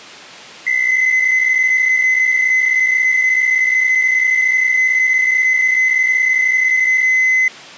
PSK63 (62.5 baud), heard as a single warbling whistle, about 2050 Hz.